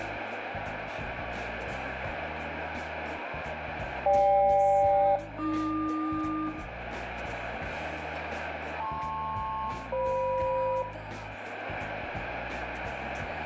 Aircraft SELCAL, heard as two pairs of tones, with radio static and room echo. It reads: GK-AQ LP-FM